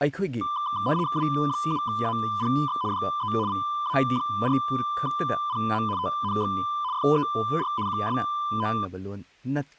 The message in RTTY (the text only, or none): W7APX DE VA4PM TNX FER QSO